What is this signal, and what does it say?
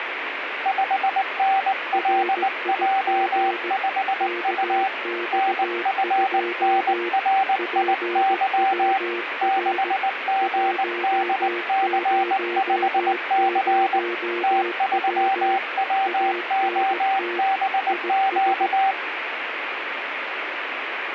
Morse code, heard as two keyed tones, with radio static. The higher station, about 19 wpm, 780 Hz: 5NLJ5U NFNRIY 6GDC5C T3WOBQ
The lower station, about 17 wpm, 350 Hz: RIG KX2 PWR 100W ANT IS